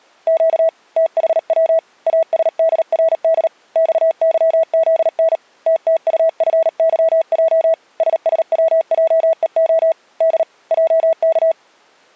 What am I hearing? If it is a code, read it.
Morse code, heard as a keyed tone, hand-sent with a paddle, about 38 wpm, 650 Hz. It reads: Q THW ASDRD XYZN TTUFYJ SSWJEO D JK